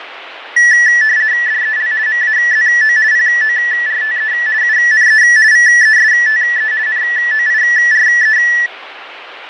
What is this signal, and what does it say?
RTTY (50 baud, 170 Hz shift), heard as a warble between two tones, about 1850 Hz centre, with radio static and fading. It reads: DEL MAZO PORTE UNE VESTE NOIRE